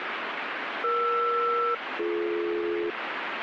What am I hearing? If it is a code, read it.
Aircraft SELCAL, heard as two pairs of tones, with radio static. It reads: ER-BD